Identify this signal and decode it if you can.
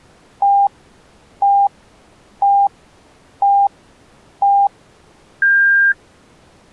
Radio time signal (five pips and a higher one, as on Chinese radio), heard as pips.